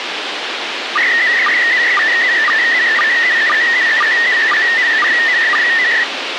SSTV (slow-scan television), PD 120, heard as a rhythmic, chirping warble, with radio hiss.